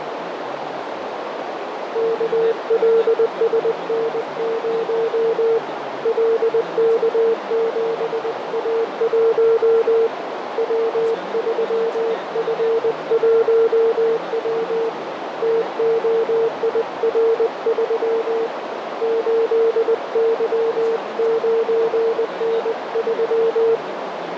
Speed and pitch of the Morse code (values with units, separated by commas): 20 wpm, 460 Hz